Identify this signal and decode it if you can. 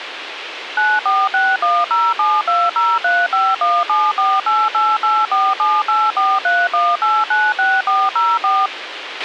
DTMF, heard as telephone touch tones, dialled by machine, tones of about 220 ms, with radio hiss and a squelch burst at the end. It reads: 9461072035174888478431896404